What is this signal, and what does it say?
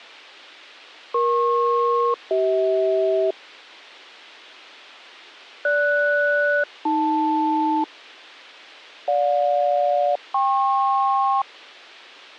Aircraft SELCAL, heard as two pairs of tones. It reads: EP-CH GS-AL GJ-KP